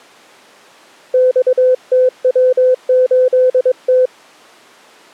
Morse code, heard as a keyed tone, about 22 wpm, 510 Hz. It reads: XTW8T